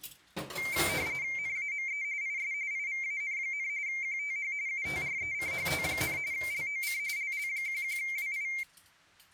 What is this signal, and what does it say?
RTTY (45.45 baud, 170 Hz shift), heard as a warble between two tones, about 2200 Hz centre, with kitchen noise. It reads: NAME IS IVAN, QTH UTRECHT, LOC LL11WI